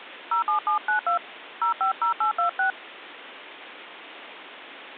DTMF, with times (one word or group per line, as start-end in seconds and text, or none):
0.3-1.2 07792
1.6-2.7 050826